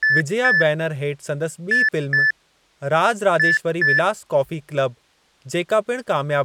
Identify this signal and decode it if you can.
Beep code, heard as beeps, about 1750 Hz, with speech in Sindhi. 2-2-2.